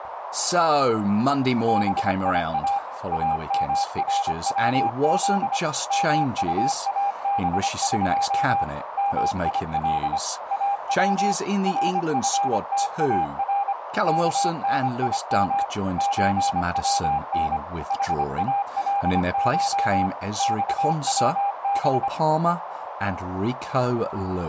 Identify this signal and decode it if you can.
Morse code (Persian alphabet), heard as a keyed tone, machine-sent, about 25 wpm, 800 Hz, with radio static, a narrow filter and speech in English. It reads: بیا امروز مطابق میل او رفتار کنیم چون حالش خوب